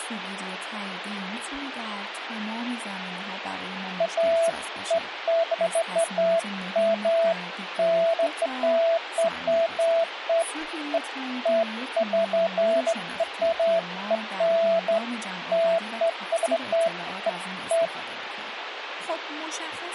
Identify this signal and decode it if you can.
Beeps of irregular length, with radio hiss and speech in Persian. There is no code.